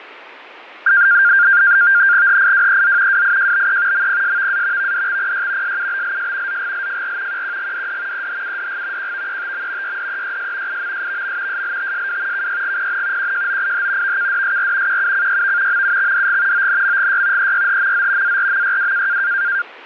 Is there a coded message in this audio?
Yes: NAVTEX (SITOR-B), 100 baud, 170 Hz shift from 0.9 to 19.6 s, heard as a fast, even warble, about 1500 Hz centre, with radio static and fading. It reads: HIWEZ WIJBE MPSVA VDXPY SUBLS ZGLFR QQGDD EHUDG QVETM YDEYS IMSVM SLTSW KYGPN QJOIH VKDSR QUCYV MUXDG ONMGY EYHMZ ARMYW